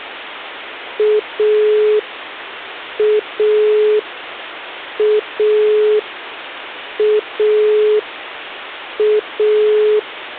Telephone call progress tone (pulsed, as in Italy), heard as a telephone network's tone, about 420 Hz, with phone line noise. Dial tone.